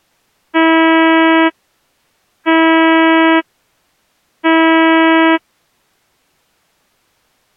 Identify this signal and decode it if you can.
Ship horn signal, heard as a ship's horn, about 320 Hz. 3 short. At sea: I am operating astern propulsion.